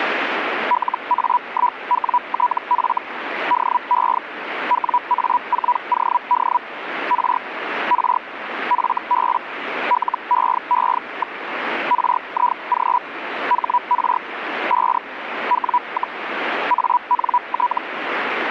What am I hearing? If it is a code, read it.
Hellschreiber (Feld-Hell, 122.5 baud), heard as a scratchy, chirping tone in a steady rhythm, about 980 Hz, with radio static. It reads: LA1WTF DE WA4OD R R FB LEE. RIG HR 5 W, ANT